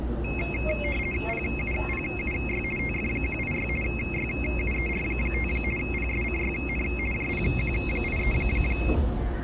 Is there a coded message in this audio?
Yes: RTTY (50 baud, 450 Hz shift) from 0.2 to 8.9 s, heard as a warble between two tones, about 2350 Hz centre, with the noise inside a subway train. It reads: PUPUY TF186 YUER5 PSCYN JPQ83